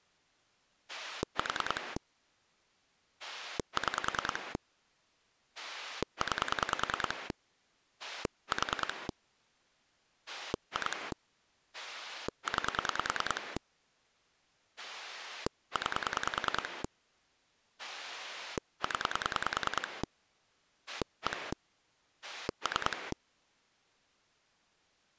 Pulse dialling, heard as a rotary dial, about 10 pulses a second. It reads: 4 6 9 4 2 9 9 0 1 3